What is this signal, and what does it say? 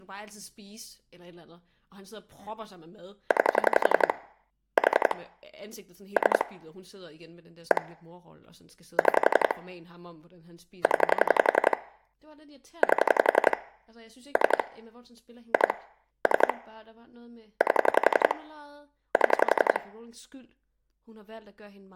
Pulse dialling, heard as clicks on a phone line, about 11 pulses a second, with speech in Danish. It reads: 9 4 3 1 6 0 8 3 2 3 8 7